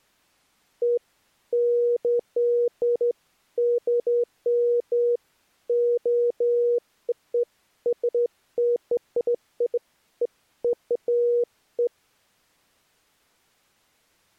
Beeps of irregular length. There is no code.